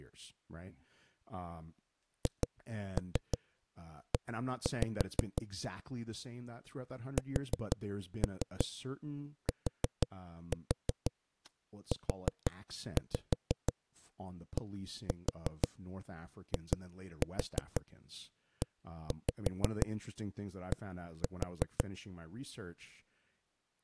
Tap code, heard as knocks on a wall, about 6 knocks a second, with speech in English. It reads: HE STUDIED